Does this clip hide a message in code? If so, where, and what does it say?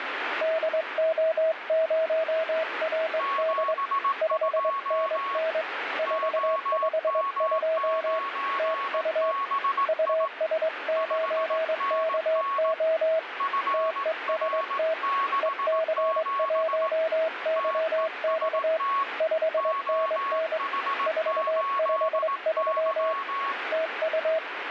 Yes: Morse code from 0.4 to 24.4 s, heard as two keyed tones, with radio static. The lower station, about 22 wpm, 640 Hz: DO0RD 5NN 452 TU US9KO TEST EC1YX 5NN 453 TU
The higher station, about 18 wpm, 1110 Hz: 72 OM9BI 5NN FR67 TEST OH8Y